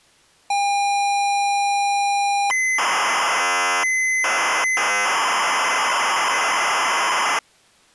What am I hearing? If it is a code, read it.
ZX Spectrum tape loading, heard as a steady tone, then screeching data.